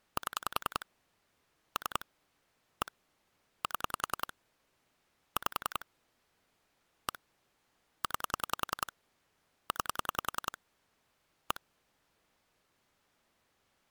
Pulse dialling, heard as clicks on a phone line, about 10 pulses a second. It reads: 7 3 1 7 5 1 9 9 1